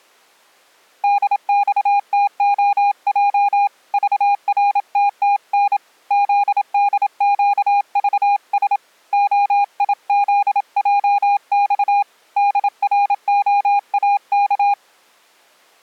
Morse code, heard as a keyed tone, hand-sent with a paddle, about 27 wpm, 810 Hz. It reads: DXTOJ VRTTN ZDQVS OIZJX DROAK